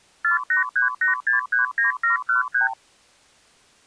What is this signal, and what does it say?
Multi-frequency trunk signalling (R2, with the far end's replies), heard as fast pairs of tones, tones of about 130 ms. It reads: 4838639713